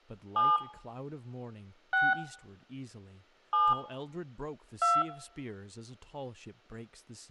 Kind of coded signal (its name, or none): DTMF